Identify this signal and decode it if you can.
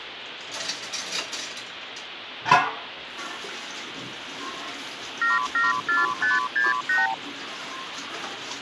Multi-frequency trunk signalling (R2, with the far end's replies), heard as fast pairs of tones, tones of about 170 ms, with phone line noise and kitchen noise. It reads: 774568